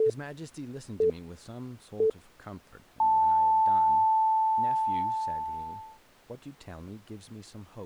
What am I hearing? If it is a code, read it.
Radio time signal (three low pips and a long one an octave up, as on NHK), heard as pips, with speech in English.